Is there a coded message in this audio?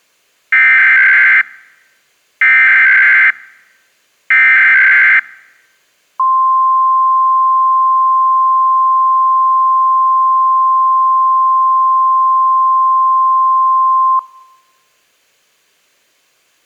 Yes: Emergency Alert System (SAME) tones (header bursts, then the 1050 Hz attention tone) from 0.5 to 14.2 s, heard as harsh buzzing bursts, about 520.83 baud.